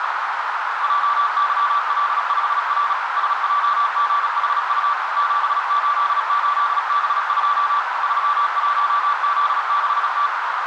Morse code, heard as a keyed tone, machine-sent, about 36 wpm, 1160 Hz, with heavy radio static and a narrow filter. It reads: JYL5R SJGHU 788B2 31Z6T